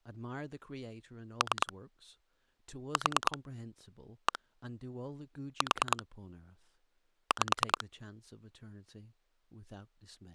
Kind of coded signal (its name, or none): pulse dialling